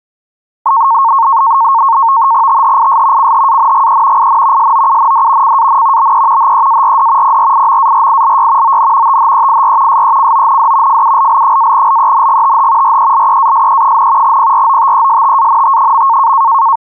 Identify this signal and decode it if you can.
NAVTEX (SITOR-B), 100 baud, 170 Hz shift, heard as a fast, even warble, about 1000 Hz centre. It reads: THIS CHANGE IN SOUND CAN BE HEARD PRIMARILY ON THEIR SECOND FULL-LENGTH RELEASE, PROTESTANT.